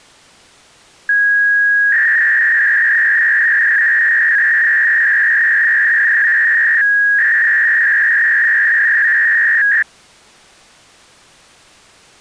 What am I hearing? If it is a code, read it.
300-baud modem data (V.21 tones), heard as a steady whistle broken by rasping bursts, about 300 baud, 200 Hz shift.